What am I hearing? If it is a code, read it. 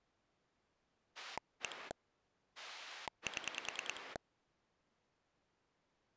Pulse dialling, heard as a rotary dial, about 10 pulses a second. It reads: 1 7